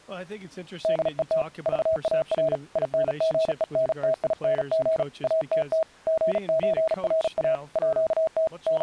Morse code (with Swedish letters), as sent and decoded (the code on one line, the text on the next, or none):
-.. . - / ...- .- .-. / .. -. --. . -. - .. -. --. / .- - - / --. ---. .-. .- / .--.- - / …
DET VAR INGENTING ATT GÖRA ÅT …